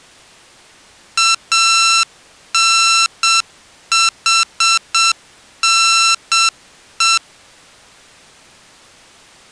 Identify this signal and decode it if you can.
Morse code (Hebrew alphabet), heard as electronic beeps, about 7 wpm, 1340 Hz. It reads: אנחנו